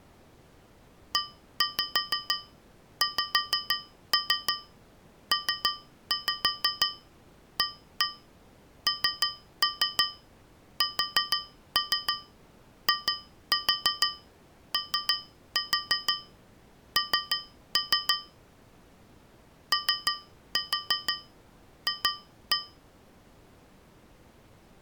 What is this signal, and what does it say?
Tap code, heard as taps on a metal pipe, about 6 knocks a second. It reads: EXPANSION OF